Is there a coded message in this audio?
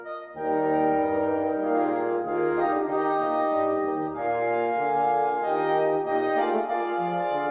No.